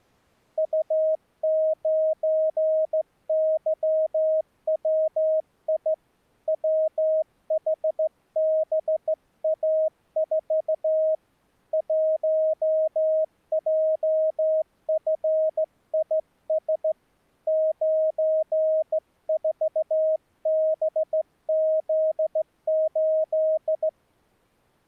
Morse code, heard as a keyed tone, hand-sent with a straight key, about 15 wpm, 630 Hz. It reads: U9YWI WHBA4 1JFIS 94BZ8